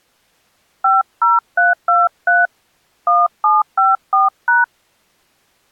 DTMF, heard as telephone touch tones, dialled by hand, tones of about 180 ms. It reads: 50323 1754#